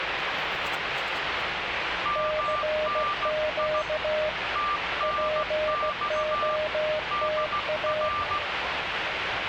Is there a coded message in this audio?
Yes: Morse code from 2.0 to 8.4 s, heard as two keyed tones, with radio static and the noise inside a subway train. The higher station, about 16 wpm, 1180 Hz: MNI TNX DR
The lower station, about 16 wpm, 620 Hz: CQ POTA